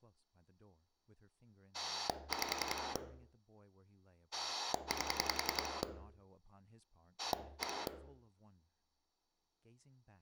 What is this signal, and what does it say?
Pulse dialling, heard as a rotary dial, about 10 pulses a second, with speech in English. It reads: 5 8 1